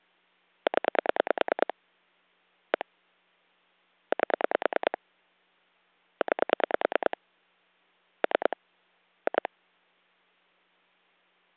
Pulse dialling, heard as clicks on a phone line, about 9 pulses a second. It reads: 0 1 8 9 3 2